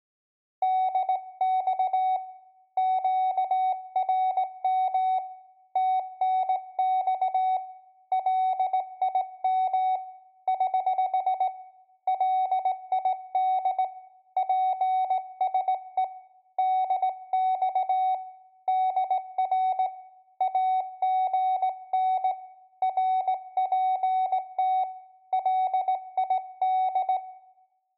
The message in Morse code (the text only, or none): DX QRM TNX LIM <HH> LID PSE DX DR AGN RPT LID